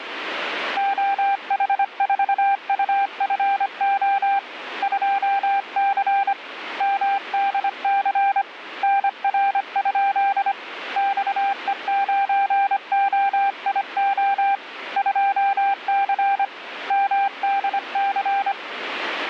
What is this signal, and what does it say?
Morse code, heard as a keyed tone, hand-sent with a paddle, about 25 wpm, 790 Hz, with radio static. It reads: OH4UFO 2C MDC NR? XE9OIO 2C MDC